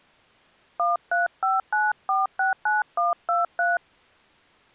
DTMF, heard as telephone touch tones, dialled by hand, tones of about 170 ms. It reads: 1359469123